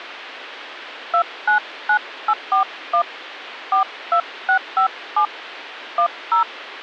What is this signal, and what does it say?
DTMF, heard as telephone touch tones, dialled by hand, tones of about 80 ms. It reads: 299841 42657 10